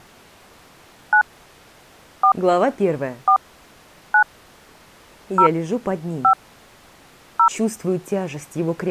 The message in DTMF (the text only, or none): 9 4 4 9 0 5 0